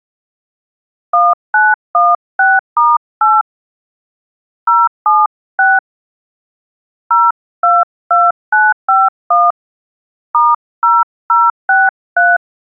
DTMF, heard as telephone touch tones, dialled by hand, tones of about 200 ms. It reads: 1916*8 076 022951 *0063